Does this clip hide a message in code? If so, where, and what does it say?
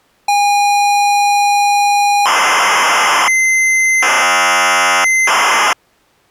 Yes: ZX Spectrum tape loading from 0.3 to 5.7 s, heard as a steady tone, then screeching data.